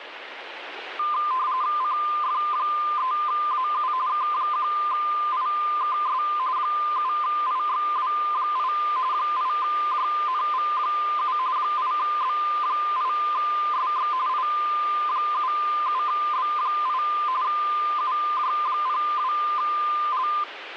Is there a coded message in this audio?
Yes: RTTY (45.45 baud, 170 Hz shift) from 1.0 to 20.4 s, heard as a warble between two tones, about 1120 Hz centre, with radio static. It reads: CF3AU K1IKS 7IXW8 8JNV7 8B8SX I77B8 UJ02L